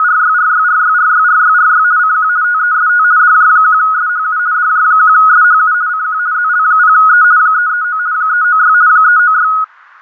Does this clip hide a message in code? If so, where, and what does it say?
Yes: RTTY (50 baud, 170 Hz shift) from 0.0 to 9.6 s, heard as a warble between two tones, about 1360 Hz centre. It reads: … CQ TEST DJ1SHU DJ1SHU CQ ZL0E 339 396 396